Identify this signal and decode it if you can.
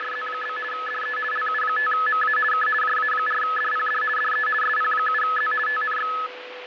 RTTY (50 baud, 450 Hz shift), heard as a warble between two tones, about 1500 Hz centre, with radio static, fading and a steady whistle near 500 Hz. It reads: … DE LU5MA K JA4DPD DE SP7Z TNX